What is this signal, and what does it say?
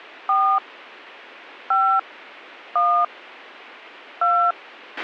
DTMF, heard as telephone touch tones, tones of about 290 ms, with a squelch burst at the end. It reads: 4 5 1 2